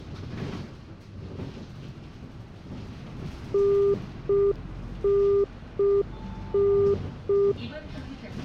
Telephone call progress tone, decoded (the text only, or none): congestion tone